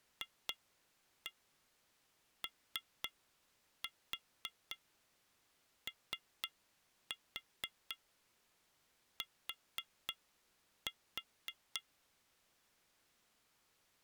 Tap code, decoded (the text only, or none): FOOT